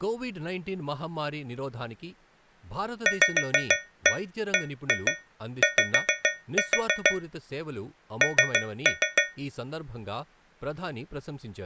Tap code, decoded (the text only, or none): VBY N